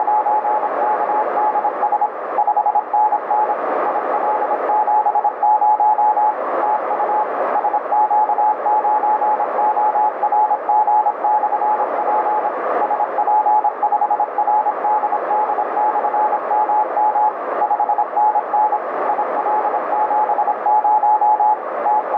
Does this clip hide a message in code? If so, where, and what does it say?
Yes: Morse code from 0.0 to 22.2 s, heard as a keyed tone, machine-sent, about 26 wpm, 850 Hz, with heavy radio static and a narrow filter. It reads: … 5NN IL70 TU SQ9ORG/P SP5RDD/MM 5NN IL70 …